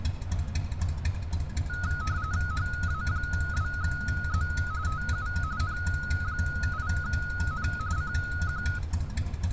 RTTY (45.45 baud, 170 Hz shift), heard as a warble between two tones, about 1360 Hz centre, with street noise. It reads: HA2Z TU N8N CQ